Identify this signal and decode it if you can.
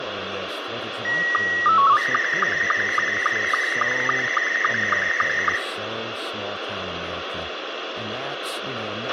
SSTV (slow-scan television), Scottie S2, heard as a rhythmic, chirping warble, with radio hiss, a squelch burst at the end, room echo and speech in English.